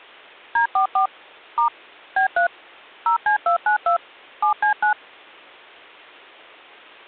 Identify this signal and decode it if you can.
DTMF, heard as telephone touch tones, dialled by machine, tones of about 110 ms. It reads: D44 * B3 0C292 7C9